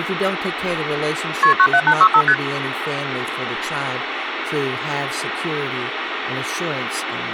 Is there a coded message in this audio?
Yes: multi-frequency trunk signalling (R1, as on North American trunks) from 1.4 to 2.3 s, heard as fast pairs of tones, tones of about 70 ms, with phone line noise and speech in English. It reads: KP 97865 ST